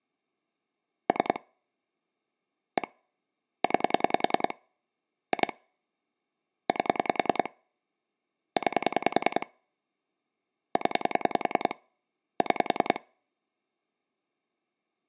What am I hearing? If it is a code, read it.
Pulse dialling, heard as clicks on a phone line, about 10 pulses a second. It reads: 3 1 9 2 8 9 0 6